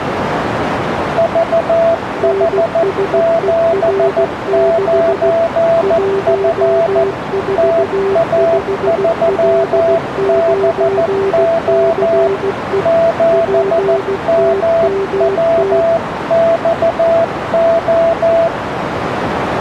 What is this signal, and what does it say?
Morse code, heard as two keyed tones, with radio static and a narrow filter. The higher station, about 14 wpm, 670 Hz: VH79F TA3BO 7MWXO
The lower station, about 16 wpm, 390 Hz: NSER6 145L9CE PTMT